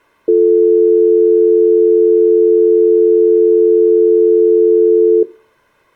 Telephone call progress tone (North American or UK plan), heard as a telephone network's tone, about 350, 440 Hz. Dial tone.